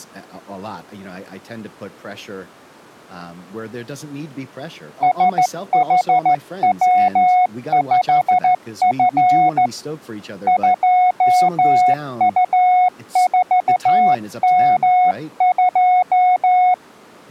Morse code, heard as a keyed tone, hand-sent with a straight key, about 14 wpm, 730 Hz, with speech in English. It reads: SHW5F 2U4M2